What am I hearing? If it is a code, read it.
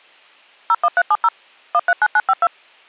DTMF, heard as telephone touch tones, dialled by machine, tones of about 50 ms. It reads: 01370 139952